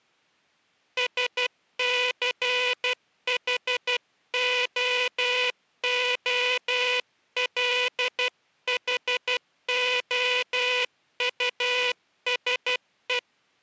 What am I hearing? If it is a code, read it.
Morse code, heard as a buzzer, hand-sent with a paddle, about 12 wpm. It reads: SCHOOLHOUSE